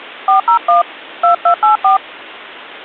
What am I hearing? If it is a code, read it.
DTMF, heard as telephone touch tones, dialled by hand, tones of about 110 ms. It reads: 401 2284